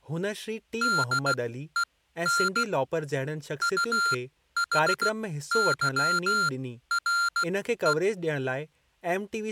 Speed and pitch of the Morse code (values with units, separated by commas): 16 wpm, spaced as for 12 wpm, 1390 Hz